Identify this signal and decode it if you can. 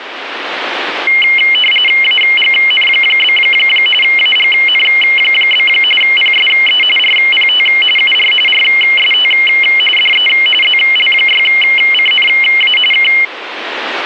RTTY (45.45 baud, 850 Hz shift), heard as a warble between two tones, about 2550 Hz centre, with radio static. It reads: AGN? AGN? PSE RPT UR RST DE ZL6CNA K